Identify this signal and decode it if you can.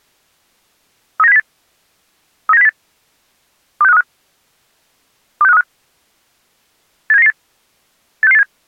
Five-tone selective call (EEA), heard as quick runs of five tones, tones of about 40 ms. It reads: 39708 39708 26535 26535 87998 86687